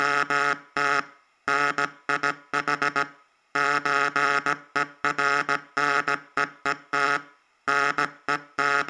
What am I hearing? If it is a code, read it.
Morse code (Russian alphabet), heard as a buzzer, hand-sent with a paddle, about 17 wpm, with room echo. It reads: … НИХ ЧЕРНЕЕТ …